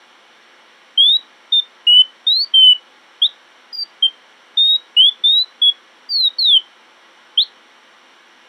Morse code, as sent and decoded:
none

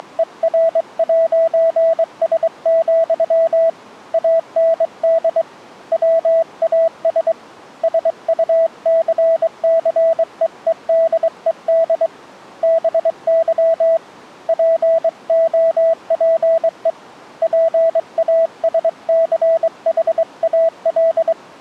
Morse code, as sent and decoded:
… / .- -. -.. / .-- .- ... / ... ..- -.-. -.-. . . -.. . -.. / -... -.-- / .--. --- .--. . / .--. .- ... -.-. .... .- .-..
… AND WAS SUCCEEDED BY POPE PASCHAL

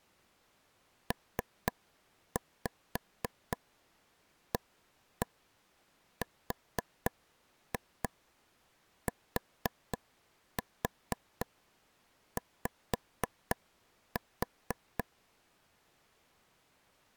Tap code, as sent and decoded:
3-5 1-1 4-2 4-4 5-4
PARTY

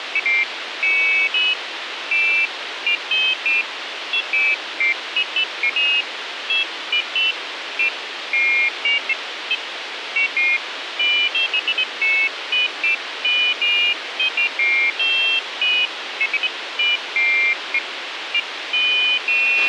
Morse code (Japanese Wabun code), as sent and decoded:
none

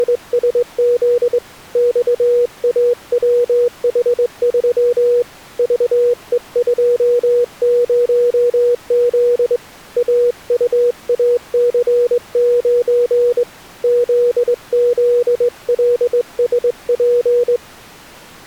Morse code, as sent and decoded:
… / -..- .- .-- .... ...-- / ...- . ..--- ----- --.. / .- ..- .- -.-. ----. / --.. --.. .-.. ... .--.
… XAWH3 VE20Z AUAC9 ZZLSP

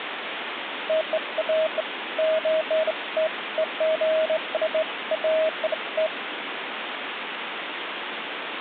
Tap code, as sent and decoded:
none

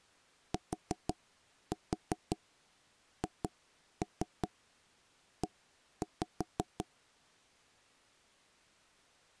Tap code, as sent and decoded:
4-4 2-3 1-5
THE

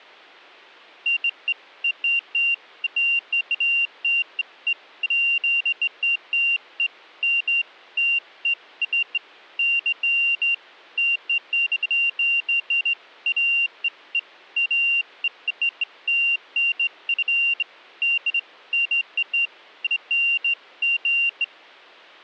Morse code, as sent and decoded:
none

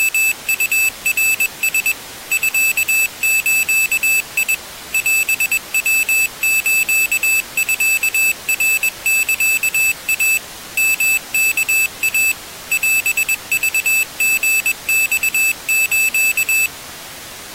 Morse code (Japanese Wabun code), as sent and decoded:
… / ..-.- ---.- .. / .-... .-- ---.- ..-.- .-. -.-.- .- / -- -.- .- / .-... ...- --. -..- ---.-
… ミズ オヤスミナサイ ヨワイ オクリマス

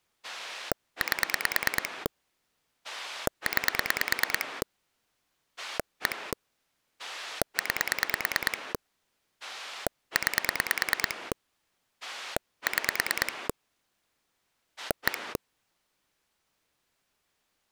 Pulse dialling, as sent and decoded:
8 / 9 / 1 / 9 / 9 / 6 / 1
8 9 1 9 9 6 1

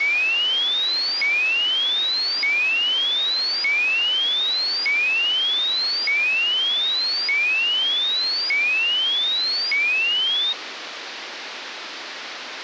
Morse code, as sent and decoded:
none

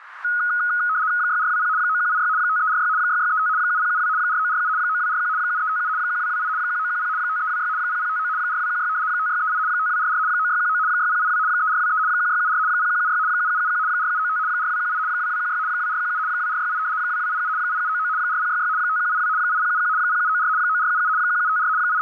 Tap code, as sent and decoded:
none

